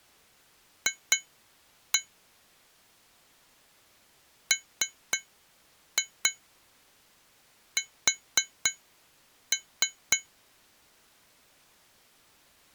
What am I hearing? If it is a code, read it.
Tap code, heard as taps on glass, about 3 knocks a second. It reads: F MS